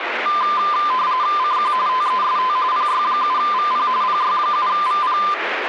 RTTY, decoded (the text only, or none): CQ TEST PY7VP PY7VP